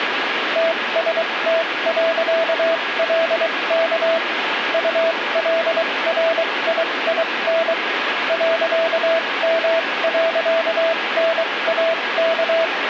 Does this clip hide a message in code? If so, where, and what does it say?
Yes: Morse code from 0.5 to 12.7 s, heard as a keyed tone, machine-sent, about 23 wpm, spaced as for 19 wpm, 660 Hz, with radio static. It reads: TST.LK ULRIIN .M.NAK